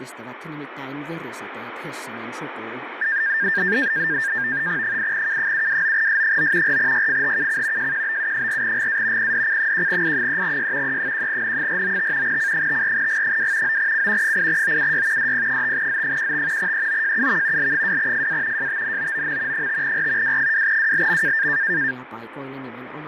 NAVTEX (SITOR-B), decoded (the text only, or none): 8K729S9 4YFHKC JQBU4GA PDC1I3Y E1N495 C54G2 9C 8OUY DP5Z15 EOJUV L2FA JTNOOM 5R W2WLM